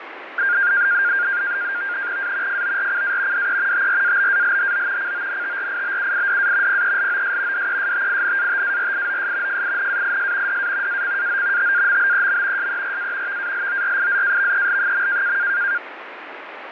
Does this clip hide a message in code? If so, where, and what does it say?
Yes: NAVTEX (SITOR-B), 100 baud, 170 Hz shift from 0.4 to 15.8 s, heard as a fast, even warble, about 1500 Hz centre, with radio static and fading. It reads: A FORCA DE TRABALHO CONTRIBUIDA PELOS DESTINATARIOS FINAIS DA ACAO TAMBEM SERA VALORIZAVEL.